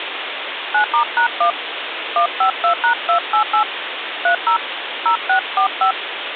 DTMF, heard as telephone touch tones, dialled by hand, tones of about 100 ms, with phone line noise. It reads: 9*#1 152#288 30 0645